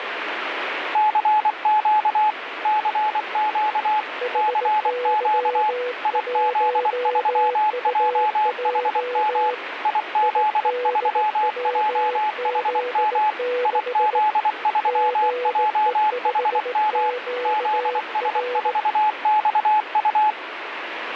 Morse code, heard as two keyed tones, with radio static. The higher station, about 24 wpm, 850 Hz: CQ CQ CQ IZ3JHM IZ3JHM IZ3JHM ZS4XU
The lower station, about 18 wpm, 490 Hz: HY1UJ IDWZ6 GE5QR